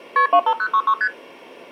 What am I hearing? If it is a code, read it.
Multi-frequency trunk signalling (R1, as on North American trunks), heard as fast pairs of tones, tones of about 70 ms. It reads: KP 25066 ST